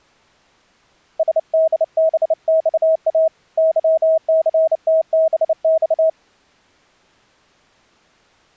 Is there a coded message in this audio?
Yes: Morse code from 1.1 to 6.2 s, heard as a keyed tone, hand-sent with a bug key, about 29 wpm, 640 Hz. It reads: SDBXA YCTBX